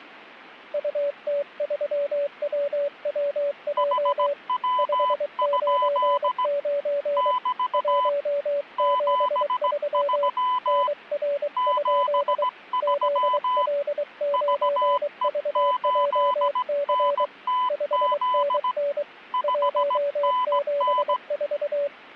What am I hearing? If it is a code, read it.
Morse code, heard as two keyed tones. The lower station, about 23 wpm, 570 Hz: UT3WWJ 599 173 NR? ZL9VJC 5NN 174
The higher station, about 17 wpm, 1000 Hz: HW? <BT> 73 73 VE8NTZ 5NN